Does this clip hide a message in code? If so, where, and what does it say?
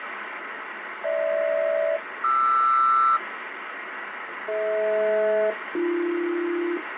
Yes: aircraft SELCAL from 1.0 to 6.8 s, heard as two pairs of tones, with radio static. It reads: GH-QR DH-AB